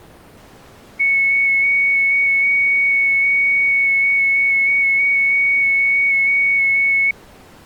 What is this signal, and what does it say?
FT8 (one signal), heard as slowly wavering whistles, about 6.25 baud.